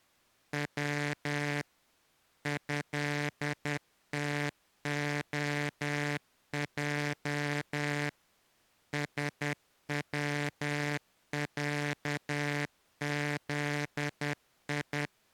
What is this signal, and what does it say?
Morse code (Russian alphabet), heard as a buzzer, machine-sent, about 10 wpm. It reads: В ЭТОЙ СВЯЗИ